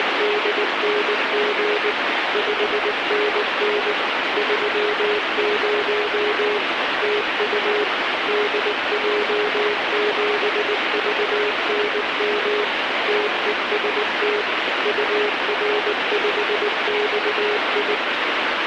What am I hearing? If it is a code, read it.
Morse code, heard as a keyed tone, machine-sent, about 19 wpm, 420 Hz, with heavy radio static. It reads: … 5NN 30 TU DJ7VNM TEST UR5XI